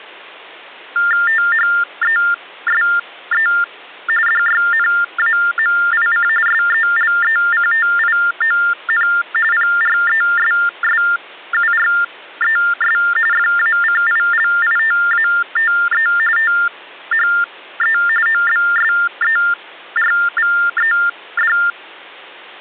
TTY/TDD text telephone tones (45.45 baud Baudot), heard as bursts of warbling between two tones, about 400 Hz shift, 1600 Hz centre. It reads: THESE DYNAMIC SELECTION PRESSURES FACILITATE THE OBSERVED